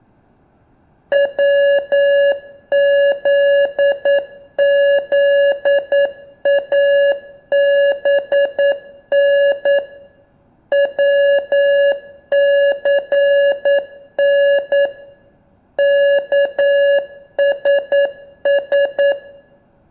Morse code, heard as electronic beeps, machine-sent, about 9 wpm, 560 Hz, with room echo. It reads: WZZABN WCN KSS